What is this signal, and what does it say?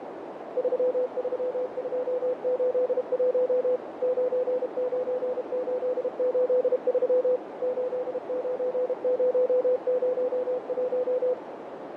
Morse code, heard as a keyed tone, machine-sent, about 32 wpm, 500 Hz, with radio static, fading and a narrow filter. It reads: 33281 99883 89001